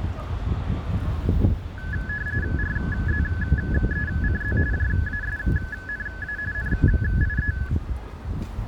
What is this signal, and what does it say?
RTTY (45.45 baud, 170 Hz shift), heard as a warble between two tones, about 1600 Hz centre, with the noise of a residential street. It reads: RZECZ JASNA NIE